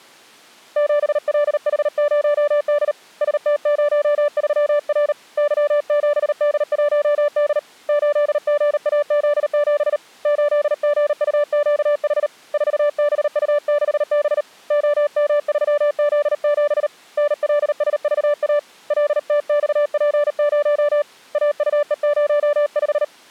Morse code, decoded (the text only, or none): 7LH0D ST03R Y7D1D 8GAZ7 8GUQH 4BU6B OM3Z7 NLSVA LTXP0 AUE05